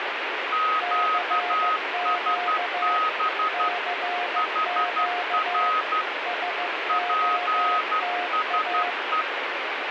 Morse code, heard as two keyed tones, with radio static. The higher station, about 12 wpm, 1260 Hz: QSB HR PSE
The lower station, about 15 wpm, 710 Hz: CQ CQ SOTA